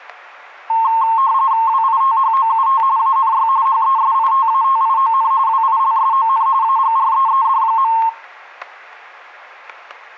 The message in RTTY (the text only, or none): WITHOUT ANY HESITATION WILSON AGREED.